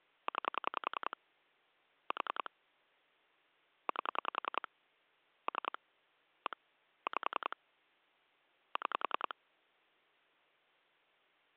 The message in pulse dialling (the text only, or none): 9 4 8 3 1 5 6